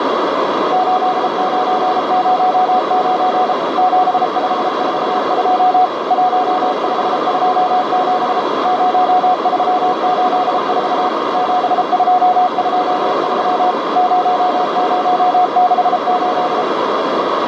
Morse code, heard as a keyed tone, machine-sent, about 33 wpm, 730 Hz, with heavy radio static and a narrow filter. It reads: 8909 7542 1527 0384 7223 0068